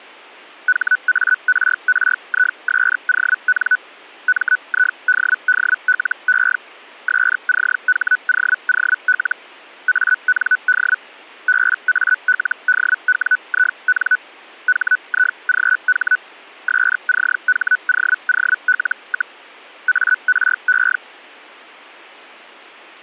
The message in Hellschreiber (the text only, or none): HARRISON MIDDLE SCHOOL AND BALDWIN HIGH SCHOOL, ARE